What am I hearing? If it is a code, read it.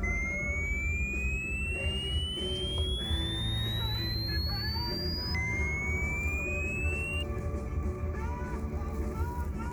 A tone that sweeps in pitch again and again, with the noise inside a car. There is no code.